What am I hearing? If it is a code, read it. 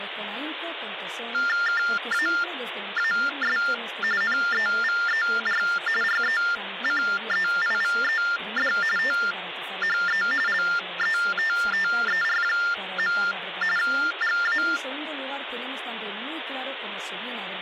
TTY/TDD text telephone tones (45.45 baud Baudot), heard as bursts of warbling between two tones, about 400 Hz shift, 1600 Hz centre, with phone line noise. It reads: KAAS NEVER RECEIVED THE LETTER. GA